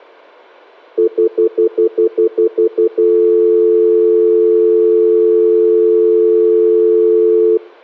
Telephone call progress tone (North American plan), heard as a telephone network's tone, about 350, 440 Hz, 0.1 s on and 0.1 s off. Stutter dial tone.